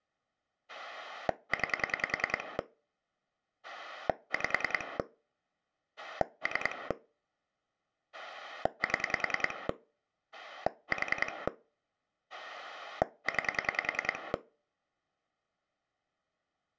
Pulse dialling, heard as a rotary dial, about 10 pulses a second. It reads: 9 5 3 7 4 9